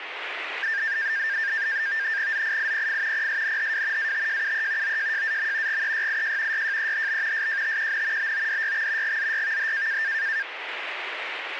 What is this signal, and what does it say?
NAVTEX (SITOR-B), 100 baud, 170 Hz shift, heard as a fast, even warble, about 1700 Hz centre, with radio static. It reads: ZIIPF PSNHW ATJUE OJJAM GEYIJ YJEHB SJTQN BODYX GZYVH